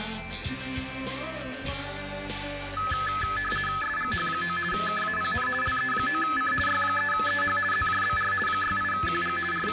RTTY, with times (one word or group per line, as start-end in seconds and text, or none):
3.8-4.6 SGH9
4.7-5.5 KAPN
5.6-6.5 LE9C
6.7-7.6 Y3EH
7.7-8.3 ZJBR
8.5-9.4 68QG
9.5-9.7 …